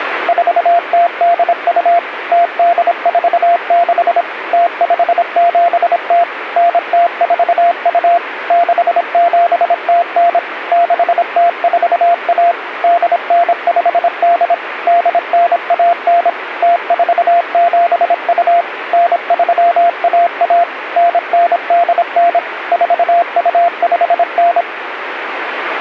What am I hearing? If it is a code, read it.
Morse code (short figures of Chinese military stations), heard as a keyed tone, machine-sent, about 26 wpm, 690 Hz, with radio static. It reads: 4082 0846 0570 9042 6709 6041 8958 8919 0472 9311 9989 4259